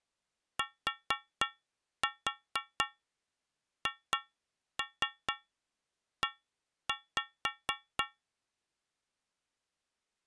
Tap code, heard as taps on a metal pipe, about 4 knocks a second. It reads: THE